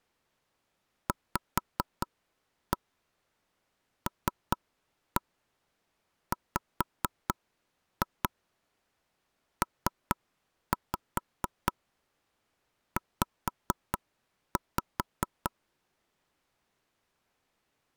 Tap code, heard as taps on a table, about 4 knocks a second. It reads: VLWPZ